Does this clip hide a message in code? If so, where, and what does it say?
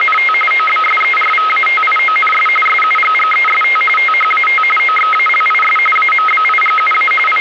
Yes: RTTY (45.45 baud, 850 Hz shift) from 0.0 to 7.4 s, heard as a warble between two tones, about 1700 Hz centre, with radio static. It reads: … OBSERVATIONS SUGGEST THAT OXALIS AMBIGUA …